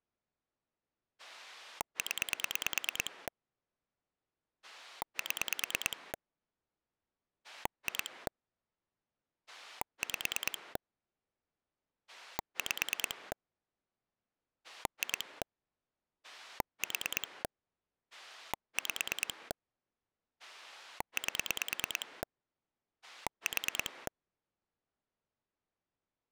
Pulse dialling, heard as a rotary dial, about 9 pulses a second. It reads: 0 7 2 5 5 2 4 5 8 4